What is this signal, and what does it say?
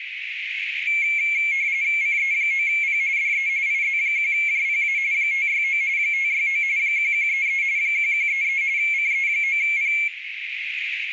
RTTY (45.45 baud, 170 Hz shift), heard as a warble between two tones, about 2250 Hz centre, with radio static, a narrow filter and room echo. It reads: CE9P DE IZ1JPA 569 569 1133 1133 CE9P